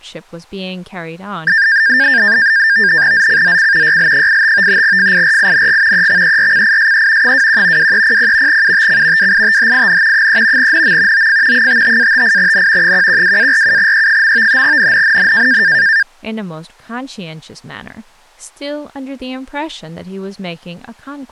NAVTEX (SITOR-B), 100 baud, 170 Hz shift, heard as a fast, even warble, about 1700 Hz centre, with speech in English. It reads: ZCZC YL85 FIRING EXERCISE 21 2300 UTC WITHIN 3 NM OF 55-58N 112-47E. NNNN